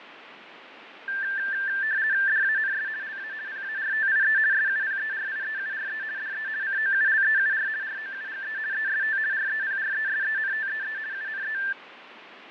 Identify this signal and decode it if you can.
RTTY (50 baud, 170 Hz shift), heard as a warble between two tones, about 1650 Hz centre, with radio static and fading. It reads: DANS LA PARTIE SUPERIEURE DE COULEUR ROUGE EST REPRESENTEE UNE